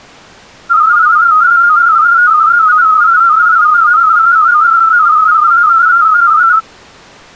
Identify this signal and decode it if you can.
Multi-tone FSK (Olivia or MFSK type), about 250 Hz wide, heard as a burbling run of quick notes, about 31.25 baud.